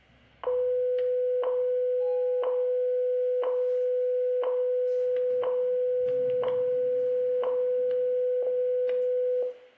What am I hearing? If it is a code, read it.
Radio time signal (WWV, Colorado), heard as ticks, one a second, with static crashes, room echo and the noise inside a lift.